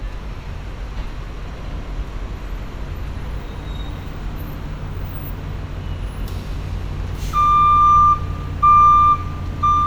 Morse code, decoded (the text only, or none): none